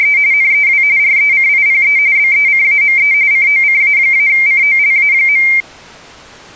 RTTY (45.45 baud, 170 Hz shift), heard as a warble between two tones, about 2200 Hz centre. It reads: … NEW RECIPE BECAME COCA-COLA.